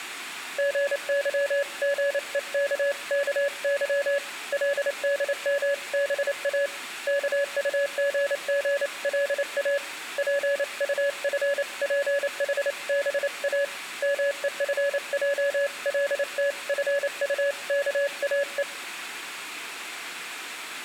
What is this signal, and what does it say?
Morse code (Korean alphabet), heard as a keyed tone, hand-sent with a paddle, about 28 wpm, 560 Hz, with room echo. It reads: 세상에 금도 있고 진주도 많거니와